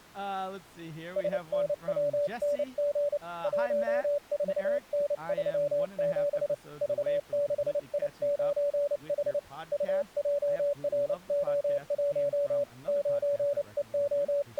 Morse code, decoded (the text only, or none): SNWNG 14N37 V6I9H UJRO1 …